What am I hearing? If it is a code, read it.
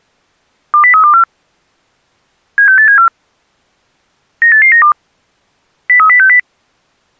Five-tone selective call (CCIR), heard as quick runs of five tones, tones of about 100 ms. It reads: 20324 76874 98892 03060